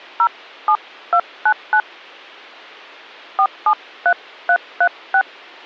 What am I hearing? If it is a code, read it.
DTMF, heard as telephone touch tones, dialled by hand, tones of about 70 ms. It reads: 07299 473336